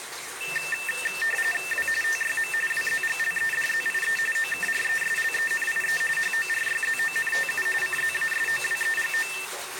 RTTY (45.45 baud, 850 Hz shift), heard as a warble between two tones, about 2250 Hz centre, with radio static and the noise of a restroom. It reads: W TYM WZGLEDZIE OKRESLENIE HORYZONTU CZASOWEGO